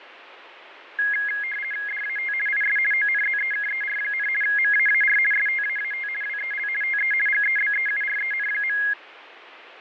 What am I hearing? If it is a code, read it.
RTTY (50 baud, 450 Hz shift), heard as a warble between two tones, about 1900 Hz centre, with radio static and fading. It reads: DAT IS ONZEKER, MAAR STAAT WEL TE GEBEUREN.